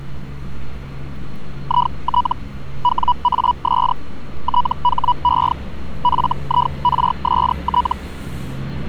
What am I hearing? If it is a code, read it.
Hellschreiber (Feld-Hell, 122.5 baud), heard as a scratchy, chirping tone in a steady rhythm, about 980 Hz, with street noise. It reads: IT WAS THE FIRST